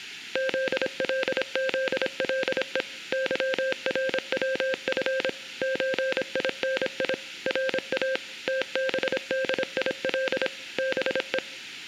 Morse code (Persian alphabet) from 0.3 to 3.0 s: زلزله

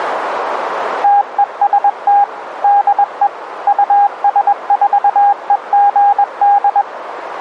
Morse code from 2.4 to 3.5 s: DE

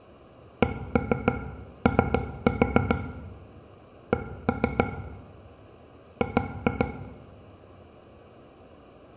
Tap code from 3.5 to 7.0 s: C G

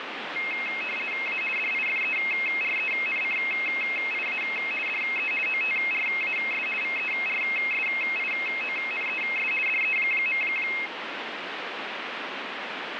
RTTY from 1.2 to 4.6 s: A DIFERENCIA

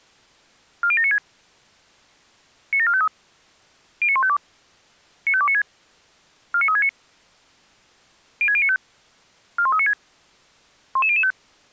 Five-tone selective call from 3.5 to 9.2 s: 09152 95296 49369 06095

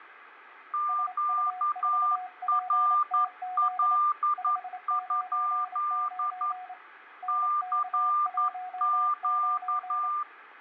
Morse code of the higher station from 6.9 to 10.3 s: CQ

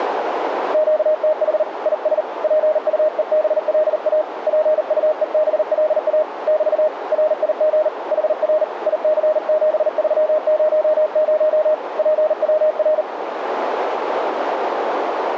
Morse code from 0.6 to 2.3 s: QTH IS

